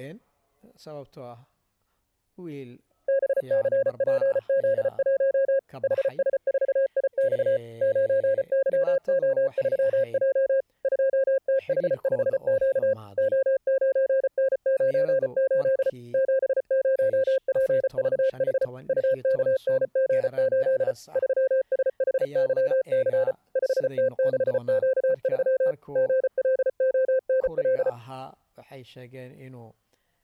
Morse code, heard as a keyed tone, machine-sent, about 34 wpm, 530 Hz. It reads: BCPZ1 HS4IX 9YO3J 2TH5Q O9N98 70PVH UKNG8 3SHYC 5T6Q3 GLONL